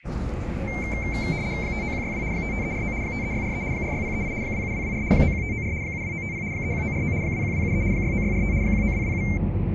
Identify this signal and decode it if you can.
RTTY (75 baud, 170 Hz shift), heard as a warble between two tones, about 2200 Hz centre, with the noise inside a bus. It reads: 59162 55349 53643 46038 27224 91594 72950 31949 21273 69645 19227